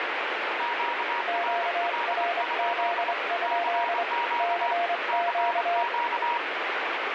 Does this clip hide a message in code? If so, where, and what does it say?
Yes: Morse code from 0.5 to 6.4 s, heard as two keyed tones, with heavy radio static. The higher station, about 24 wpm, 950 Hz: QRL? CQ CQ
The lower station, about 25 wpm, 690 Hz: QRZ? CQ